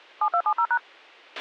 DTMF, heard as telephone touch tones, dialled by machine, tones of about 70 ms, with a squelch burst at the end. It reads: 7270#